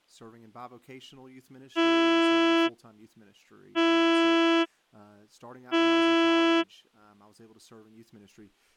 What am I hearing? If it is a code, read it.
Ship horn signal, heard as a ship's horn, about 330 Hz, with speech in English. 3 short. At sea: I am operating astern propulsion.